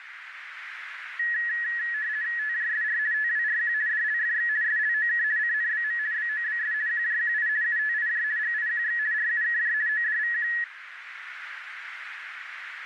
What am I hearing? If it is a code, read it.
RTTY (50 baud, 170 Hz shift), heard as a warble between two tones, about 1800 Hz centre, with radio static and a narrow filter. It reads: TJSR TWRQ DLFX SLOK CNBM BOBS QJQI UTIJ GIQX RUKJ ODVQ